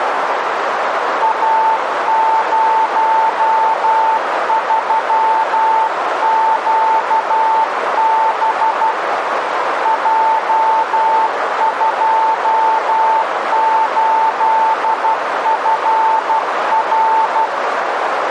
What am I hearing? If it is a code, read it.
Morse code, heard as a keyed tone, hand-sent with a paddle, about 12 wpm, 890 Hz, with radio static and a narrow filter. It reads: A03QB J28FR